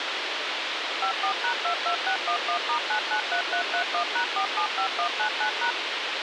DTMF, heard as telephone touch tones, dialled by machine, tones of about 90 ms, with radio hiss. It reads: 54#22611*993331#475199#